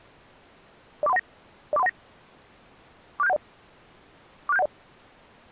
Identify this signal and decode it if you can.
Five-tone selective call (EIA), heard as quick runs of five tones, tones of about 30 ms. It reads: 04319 04319 46710 46710